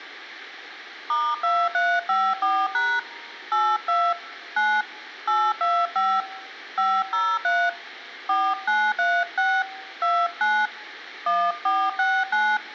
DTMF, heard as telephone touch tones, dialled by hand, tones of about 250 ms. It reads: *2354# 82 9 825 503 4936 29 1469